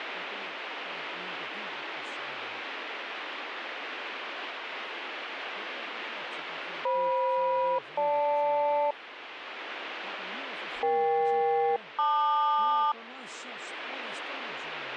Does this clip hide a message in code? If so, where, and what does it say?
Yes: aircraft SELCAL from 6.9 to 12.9 s, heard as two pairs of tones, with radio static. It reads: FM-GL EK-LQ